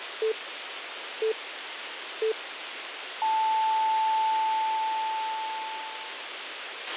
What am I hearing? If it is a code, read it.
Radio time signal (three low pips and a long one an octave up, as on NHK), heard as pips, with radio hiss and a squelch burst at the end.